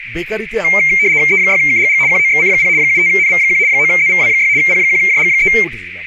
RTTY (75 baud, 170 Hz shift), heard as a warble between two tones, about 2200 Hz centre, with radio static, a narrow filter and speech in Bangla. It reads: E6KGG QOXC0 75NV1 9ZVW6 P1JG3